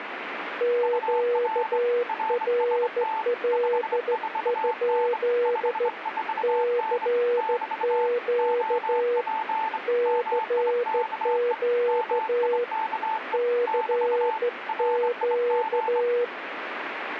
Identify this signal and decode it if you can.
Morse code, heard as two keyed tones, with radio static. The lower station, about 14 wpm, 480 Hz: QRL? CQ CQ CQ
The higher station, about 24 wpm, 880 Hz: UR RST 54N 54N <BT> OP MIKE MIKE <BT> RIG